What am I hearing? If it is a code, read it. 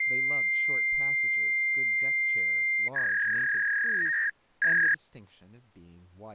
Fax machine handshake, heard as a long tone and a warble, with speech in English.